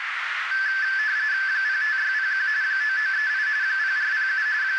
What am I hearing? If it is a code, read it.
RTTY (45.45 baud, 170 Hz shift), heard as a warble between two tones, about 1650 Hz centre, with radio static and a narrow filter. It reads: 05601 9938 0407 …